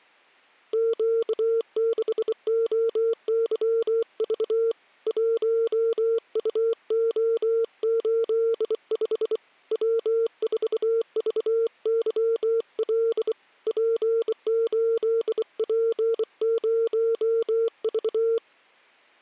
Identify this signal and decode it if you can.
Morse code, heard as a keyed tone, hand-sent with a bug key, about 24 wpm, 460 Hz. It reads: Q6OYV 1UO85 W4VYL P8P0V